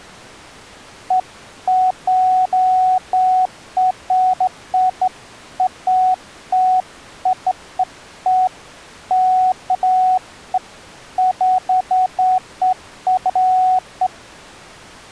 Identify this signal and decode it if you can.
Beeps of irregular length. There is no code.